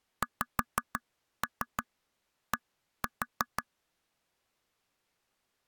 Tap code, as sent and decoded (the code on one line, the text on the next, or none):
5-3 1-4
XD